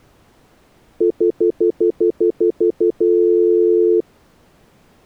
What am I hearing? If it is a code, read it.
Telephone call progress tone (North American plan), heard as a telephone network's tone, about 350, 440 Hz, 0.1 s on and 0.1 s off. Stutter dial tone.